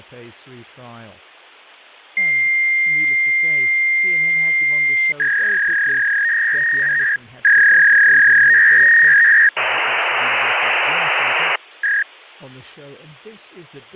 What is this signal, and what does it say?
Fax machine handshake, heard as a long tone, a warble and hiss, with speech in English.